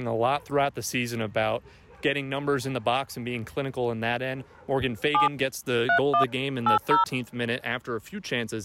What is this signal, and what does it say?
DTMF, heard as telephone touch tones, dialled by hand, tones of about 110 ms. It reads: 7 31 80